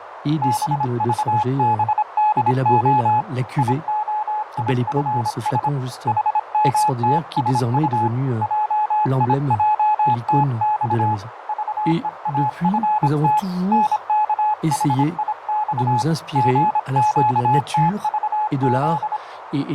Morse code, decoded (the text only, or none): BVBDO IOIFS HMTSU JIJTX VEAFT NKHIX GQTVZ